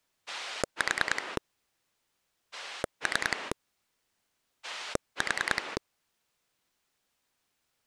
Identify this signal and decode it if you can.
Pulse dialling, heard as a rotary dial, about 10 pulses a second. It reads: 4 3 4